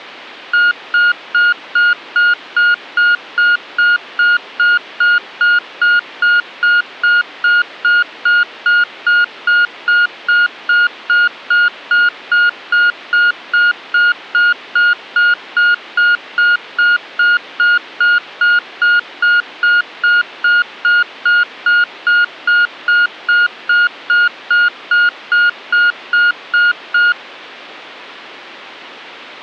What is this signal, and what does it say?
Evenly repeated beeps. There is no code.